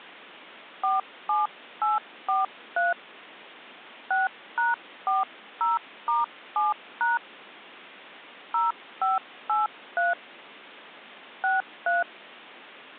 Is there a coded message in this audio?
Yes: DTMF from 0.8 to 12.0 s, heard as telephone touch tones, dialled by hand, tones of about 160 ms. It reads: 47843 6#40*7# 0583 63